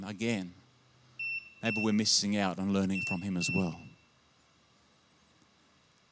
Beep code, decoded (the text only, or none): 2-2